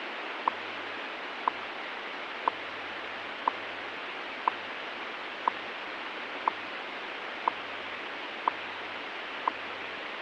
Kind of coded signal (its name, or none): radio time signal